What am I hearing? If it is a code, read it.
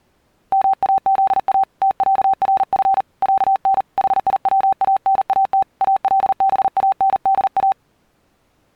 Morse code (Arabic alphabet), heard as a keyed tone, hand-sent with a paddle, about 39 wpm, 780 Hz. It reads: ماذا تعرف عن حيوانات الباندا